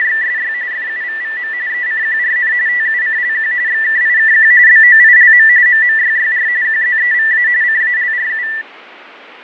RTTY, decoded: … FUVVM ECQRN TUCLQ XKIKQ BOILM MMYYR QZEVA CALRU

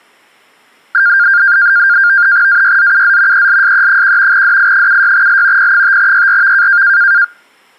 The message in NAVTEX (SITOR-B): AYZUZ ELSE1 DI76L P5YRV

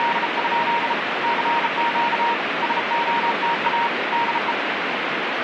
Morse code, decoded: … CQ SOTA DE

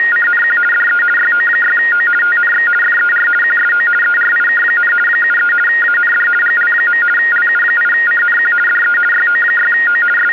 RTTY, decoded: … DE YO6O TNX FER QSO ERIK, 73 AND GL. LU8CNQ DE YO6O …

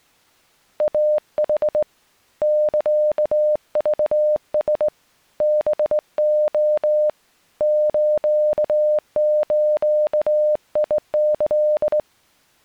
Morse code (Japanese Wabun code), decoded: イヌ サクラ ハレ スズキ

